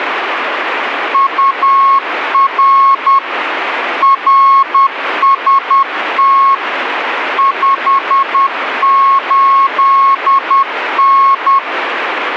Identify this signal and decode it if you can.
Morse code, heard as a keyed tone, machine-sent, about 10 wpm, 1090 Hz, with radio static. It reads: UR RST 58N